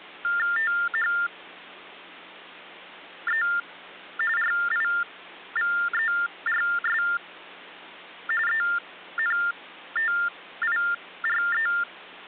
TTY/TDD text telephone tones (45.45 baud Baudot), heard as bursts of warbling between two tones, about 400 Hz shift, 1600 Hz centre, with hum. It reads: THE RIVERS ENTIRE